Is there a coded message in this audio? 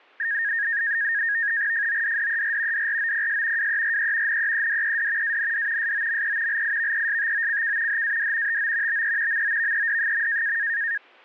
Yes: NAVTEX (SITOR-B), 100 baud, 170 Hz shift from 0.2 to 11.0 s, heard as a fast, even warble, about 1750 Hz centre. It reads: FODDER DROPS WERE NEEDED AND SOME LIVESTOCK HAD TO BE MOVED.